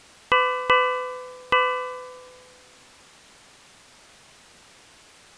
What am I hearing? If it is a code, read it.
Ship's bell, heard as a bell. 3. Three half-hours of the watch have passed.